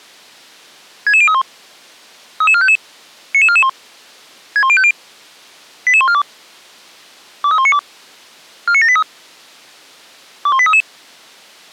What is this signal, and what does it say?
Five-tone selective call (ZVEI), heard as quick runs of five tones, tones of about 70 ms. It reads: 66031 33455 99441 61050 88142 23192 49783 21833